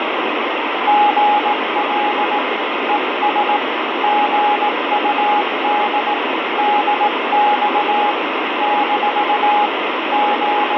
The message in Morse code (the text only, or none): GL ES GUD DX - …